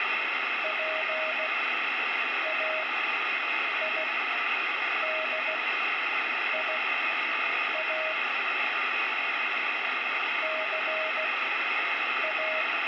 Morse code (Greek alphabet), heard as a keyed tone, machine-sent, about 16 wpm, spaced as for 7 wpm, 630 Hz, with radio static. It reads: ΠΑΙΔΙΑ ΘΑ